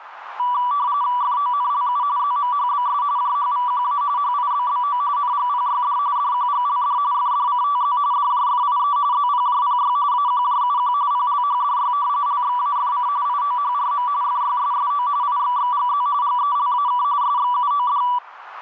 RTTY (45.45 baud, 170 Hz shift), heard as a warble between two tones, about 1070 Hz centre, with radio static and a narrow filter. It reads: FONLU ZMHBS JHVQA HIBBO NGPYD DQGLD FDCTZ DJFIE ZPJPY AQJUQ PLHDY LXAFC IOHRM FYSSO IXXGZ GELAK SXUOD